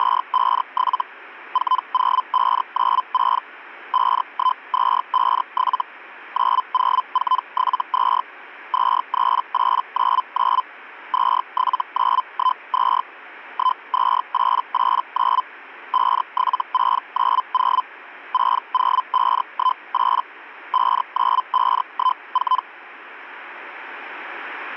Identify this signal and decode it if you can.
Hellschreiber (Feld-Hell, 122.5 baud), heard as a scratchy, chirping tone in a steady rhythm, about 1020 Hz. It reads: … 40596 51257 90472 23899 27912 12889 57690 60518 59514